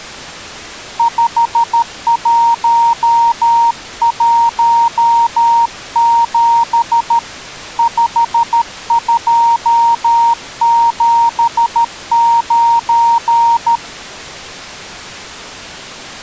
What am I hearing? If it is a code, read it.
Morse code, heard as a keyed tone, hand-sent with a paddle, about 13 wpm, 930 Hz. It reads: 5117 5279